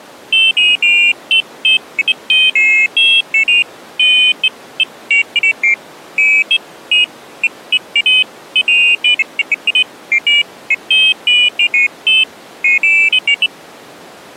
Pairs of high tones at irregular times. There is no code.